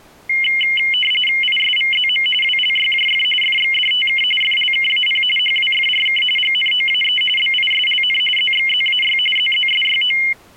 RTTY (45.45 baud, 850 Hz shift), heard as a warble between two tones, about 2550 Hz centre. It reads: ISVZM WLYJF FXDTK FLKAP HWFRK GNOAE BISLN ZXZAY ZZSYO